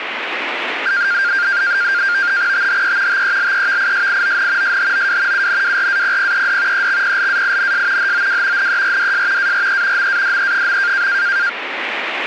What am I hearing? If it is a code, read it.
NAVTEX (SITOR-B), 100 baud, 170 Hz shift, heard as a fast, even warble, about 1500 Hz centre, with radio static. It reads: THE TELEVISION SHOW UNWRAPPED EXPLAINS HOW NERDS ARE MADE.